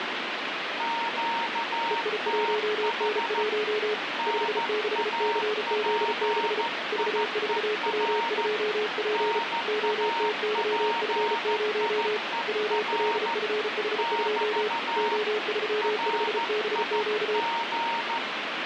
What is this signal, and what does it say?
Morse code, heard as two keyed tones, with radio static. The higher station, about 14 wpm, 930 Hz: QTH NAPIER NAPIER <BT> RIG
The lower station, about 34 wpm, 420 Hz: EI1N1 56CZ6 V4W2P OTYF0 WLFH2 O35BQ